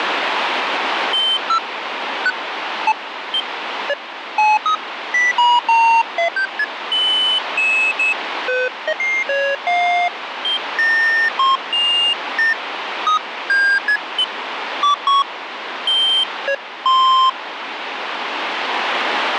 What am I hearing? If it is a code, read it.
Electronic bleeps of random pitch and length, with radio static. There is no code.